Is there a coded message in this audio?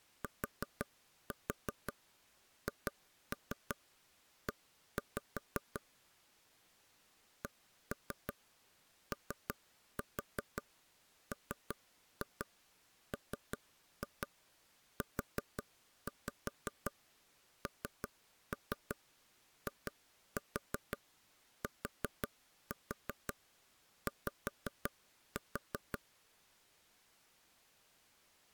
Yes: tap code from 0.2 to 26.0 s, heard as taps on a table, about 5 knocks a second. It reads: THE COMMUNITY